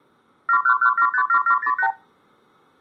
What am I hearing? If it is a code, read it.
Multi-frequency trunk signalling (R2, with the far end's replies), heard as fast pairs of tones, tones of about 80 ms, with room echo. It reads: 711757708